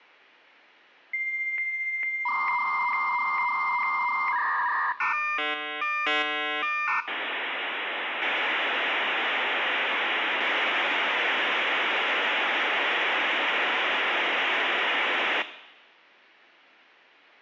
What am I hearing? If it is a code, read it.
Dial-up modem handshake (V.34 or later), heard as a whistle, warbles, then hiss, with room echo.